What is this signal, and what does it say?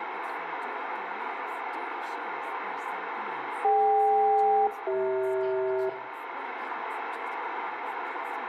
Aircraft SELCAL, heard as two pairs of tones, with radio static, room echo and speech in English. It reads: DK-CH